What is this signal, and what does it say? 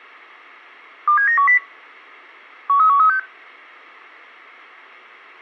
Five-tone selective call (CCIR), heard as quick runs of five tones, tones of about 100 ms, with a squelch burst at the end. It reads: 27910 13136